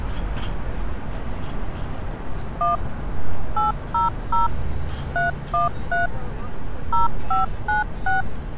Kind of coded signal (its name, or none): DTMF